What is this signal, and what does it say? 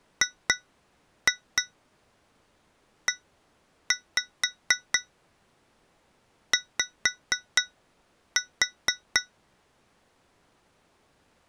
Tap code, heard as taps on glass, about 4 knocks a second. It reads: GEY